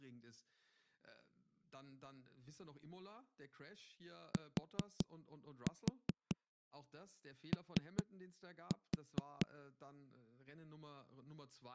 Tap code, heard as knocks on a wall, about 4 knocks a second, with speech in German. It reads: TO